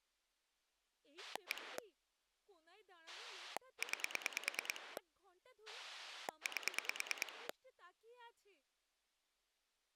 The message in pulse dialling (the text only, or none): 1 9 8